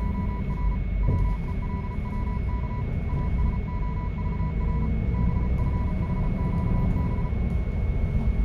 Morse code, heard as a keyed tone, hand-sent with a paddle, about 34 wpm, 990 Hz, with radio static, a steady whistle near 2200 Hz and the noise inside a bus. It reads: … WELWK ASOVR BFHQB